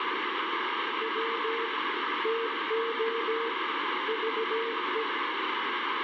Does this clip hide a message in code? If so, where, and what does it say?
Yes: Morse code (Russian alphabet) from 1.0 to 5.1 s, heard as a keyed tone, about 17 wpm, 460 Hz, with heavy radio static. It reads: В ТО ЖЕ